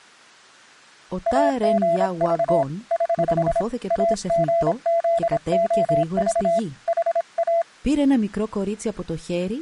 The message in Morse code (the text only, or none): AGV <HH> AGZOV HA